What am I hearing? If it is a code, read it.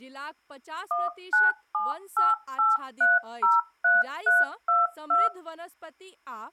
DTMF, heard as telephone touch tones, dialled by machine, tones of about 180 ms, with speech in Maithili. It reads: 19788303322